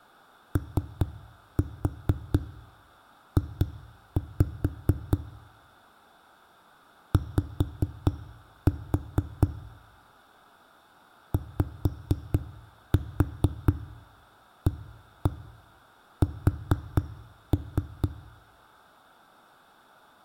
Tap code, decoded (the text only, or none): OJ Y YAS